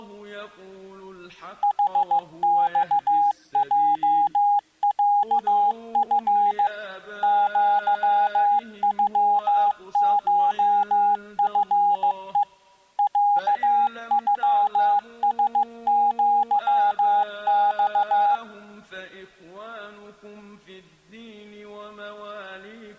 Morse code (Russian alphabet), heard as a keyed tone, machine-sent, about 15 wpm, 820 Hz. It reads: ХЬЙЯФ ЪЮШФЕ ЯЮСЪЬ